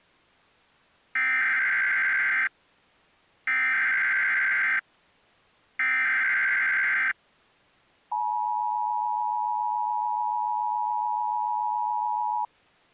Emergency Alert System (SAME) tones (header bursts, then the 853 and 960 Hz attention tone), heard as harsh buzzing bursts, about 520.83 baud.